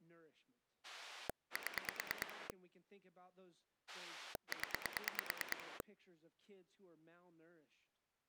Pulse dialling, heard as a rotary dial, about 9 pulses a second, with speech in English. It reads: 7 0